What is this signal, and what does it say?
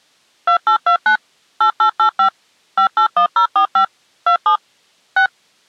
DTMF, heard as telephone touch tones, dialled by machine, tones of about 100 ms. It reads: 2829 8885 581045 27 6